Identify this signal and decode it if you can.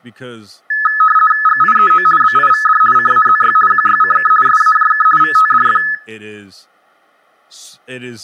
RTTY (50 baud, 450 Hz shift), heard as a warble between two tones, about 1500 Hz centre, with speech in English. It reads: GIEO BIVD CAZY QYCK SAJK VTDF